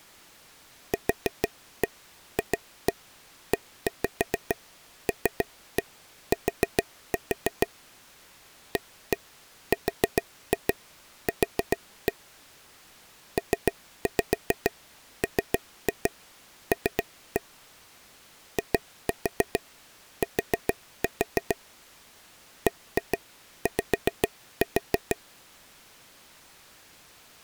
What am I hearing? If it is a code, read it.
Tap code, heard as taps on a table, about 6 knocks a second. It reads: QFELT ARQ PML IT BY